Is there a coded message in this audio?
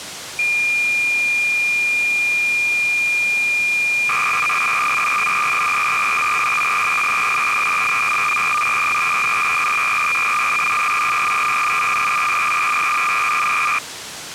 Yes: cassette data (Kansas City type), 300 baud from 0.4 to 13.8 s, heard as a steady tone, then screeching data, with tape hiss.